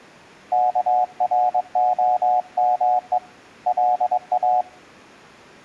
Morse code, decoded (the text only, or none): KROME LA